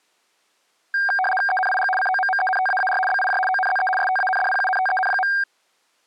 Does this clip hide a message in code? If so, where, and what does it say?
Yes: RTTY (75 baud, 850 Hz shift) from 0.9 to 5.4 s, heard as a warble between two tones, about 1170 Hz centre. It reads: ENIG COMMENTAAR BIJ ONZE STANDPUNTEN.